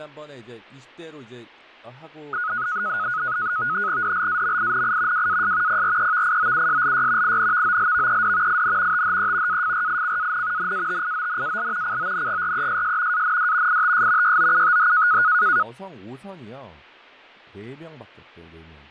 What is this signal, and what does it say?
NAVTEX (SITOR-B), 100 baud, 170 Hz shift, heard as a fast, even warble, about 1360 Hz centre, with fading and speech in Korean. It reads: DLAMINI WAS PREVIOUSLY INVOLVED IN THE AFRICAN NATIONAL CONGRESS AND ITS YOUTH